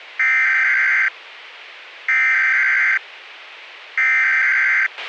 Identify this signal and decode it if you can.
Emergency Alert System (SAME) tones (header bursts), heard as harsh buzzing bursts, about 520.83 baud, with radio hiss and a squelch burst at the end.